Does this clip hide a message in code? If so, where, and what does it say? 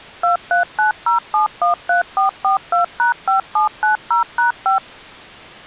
Yes: DTMF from 0.2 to 4.8 s, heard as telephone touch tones, dialled by machine, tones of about 120 ms. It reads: 2390713442#5790#5